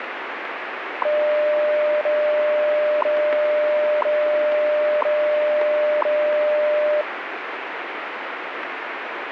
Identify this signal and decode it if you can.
Radio time signal (WWV, Colorado), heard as ticks, one a second, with radio static.